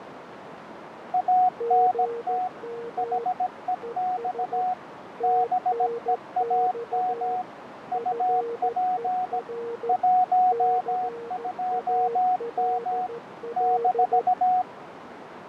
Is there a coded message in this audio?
Yes: Morse code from 1.1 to 14.7 s, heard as two keyed tones, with radio static, fading and a narrow filter. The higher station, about 17 wpm, 740 Hz: ANT HEX BEAM UP 12M -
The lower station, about 14 wpm, 470 Hz: GM ES TNX FER CALL